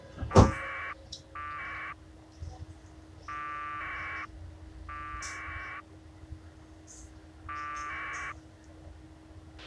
Packet radio (AX.25, as in APRS), 1200 baud, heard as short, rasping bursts, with a squelch burst at the end and the noise inside a subway train.